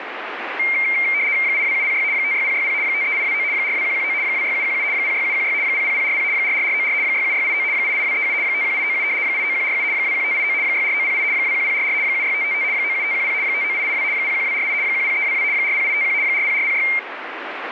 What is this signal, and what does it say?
RTTY (75 baud, 170 Hz shift), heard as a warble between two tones, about 2200 Hz centre, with radio static. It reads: 82706 56060 53829 42119 26717 06716 00040 44494 67689 88237 51897 89147 21589 64908 21044 76555 97510 59882 01248 10322 40851 40406